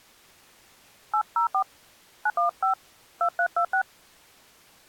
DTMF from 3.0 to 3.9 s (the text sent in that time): 2326